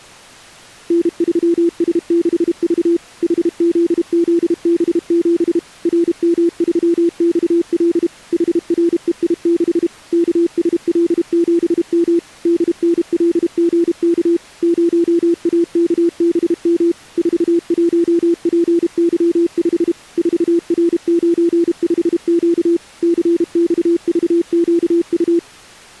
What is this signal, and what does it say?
Morse code, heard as a keyed tone, machine-sent, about 32 wpm, 340 Hz. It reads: N3S6V HZZB7 RM3XL HREI6 KSL7M DNLGK 0AKBM 41PY5 4R95Q CXVQU